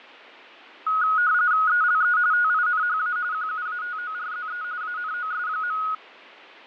RTTY (45.45 baud, 170 Hz shift), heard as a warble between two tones, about 1360 Hz centre, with radio static and fading. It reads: ELE TINHA QUATORZE ANOS.